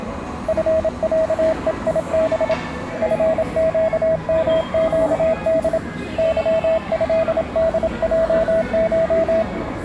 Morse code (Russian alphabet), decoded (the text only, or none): ФЯЕИБ ФЩМЩД ЫЭДЙШ